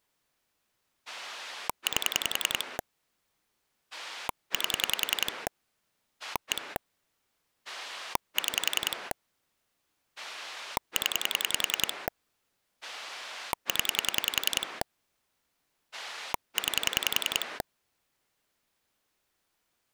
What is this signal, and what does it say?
Pulse dialling, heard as a rotary dial, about 10 pulses a second. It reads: 8 8 1 6 0 0 9